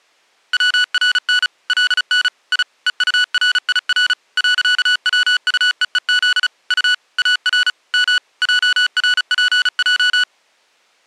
Morse code, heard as electronic beeps, machine-sent, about 35 wpm, 1480 Hz. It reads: WRN LN I EURIR .WUEEZ U AR M JRPJ